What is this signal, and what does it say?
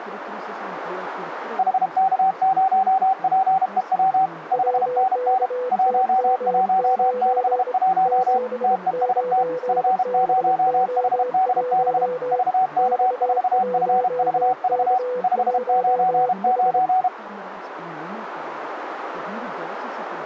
Morse code, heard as two keyed tones, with radio static. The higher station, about 32 wpm, 760 Hz: HK0PEW 5NN 1161 TEST F0HDB VK4FVV 599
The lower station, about 26 wpm, 500 Hz: WKTM9 79BO1 X1K1H